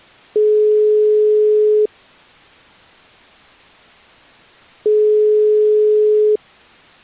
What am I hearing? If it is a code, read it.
Telephone call progress tone (single-tone plan, as in most of Europe), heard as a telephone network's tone, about 420 Hz, 1.5 s on and 3 s off. Ringback tone.